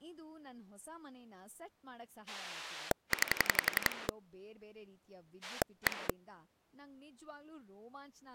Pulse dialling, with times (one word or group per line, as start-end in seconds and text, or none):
2.3-4.1 9
5.4-6.1 1